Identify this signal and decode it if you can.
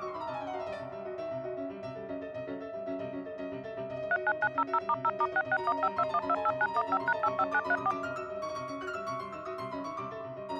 DTMF, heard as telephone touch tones, dialled by machine, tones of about 50 ms. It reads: 39900*0*66152128915#85934